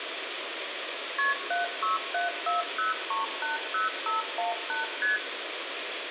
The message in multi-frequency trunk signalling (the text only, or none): KP 76740380518 ST